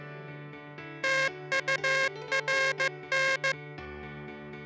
Morse code, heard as a buzzer, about 15 wpm. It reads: TURN